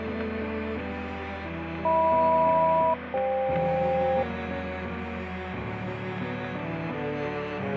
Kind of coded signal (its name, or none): aircraft SELCAL